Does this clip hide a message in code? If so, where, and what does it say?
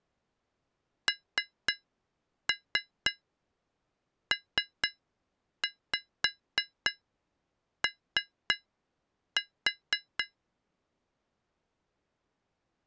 Yes: tap code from 1.1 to 10.4 s, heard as taps on glass, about 3 knocks a second. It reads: NPO